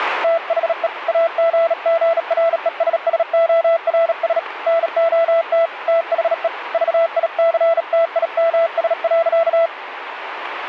Morse code, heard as a keyed tone, hand-sent with a bug key, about 37 wpm, 670 Hz, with radio static. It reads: THE AGGRESSORS NOT THE VICTIMS.